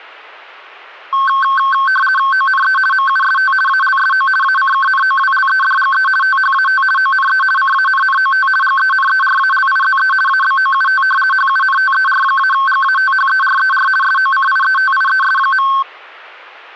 RTTY (50 baud, 450 Hz shift), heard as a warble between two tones, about 1310 Hz centre. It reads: ONE MUST ALSO ACKNOWLEDGE THAT ONE CANNOT GENERALIZE ABOUT HUNTER-GATHERER SOCIETIES.